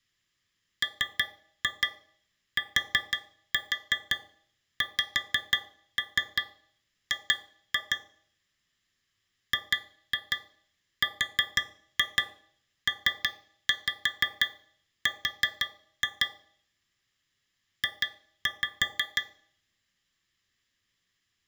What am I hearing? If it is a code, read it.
Tap code, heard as taps on a metal pipe, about 6 knocks a second. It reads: MTXG GRPR J